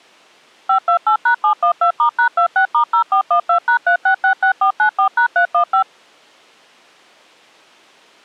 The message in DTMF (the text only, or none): 528#712*#26*0412#3666494#315